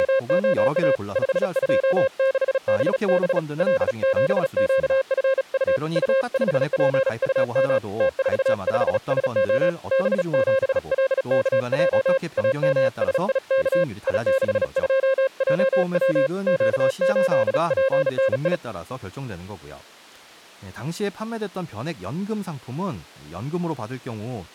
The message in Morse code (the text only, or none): … 526BB L7QFU U5PUM T45SO B7LKJ AMSIK I62JW Q8PNI